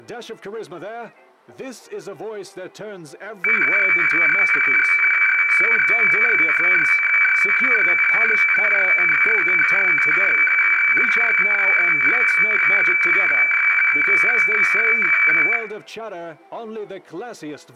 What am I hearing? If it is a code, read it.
Weather fax (radiofax), 120 lines a minute, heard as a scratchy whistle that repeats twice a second, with room echo.